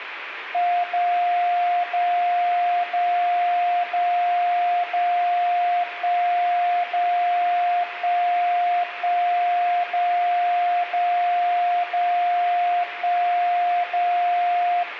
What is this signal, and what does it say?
Radio time signal (DCF77), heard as a tone whose level steps once a second, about 710 Hz, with radio static and room echo. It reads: 0 0 0 0 0 1 0 1 1 0 0 0 1 0